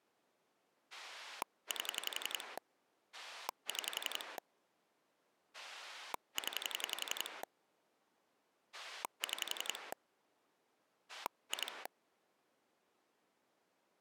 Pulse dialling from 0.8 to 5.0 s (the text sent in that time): 8 6